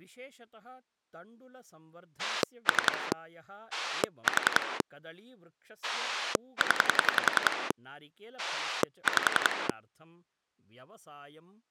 Pulse dialling, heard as a rotary dial, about 10 pulses a second, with speech in Sanskrit. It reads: 3 4 0 5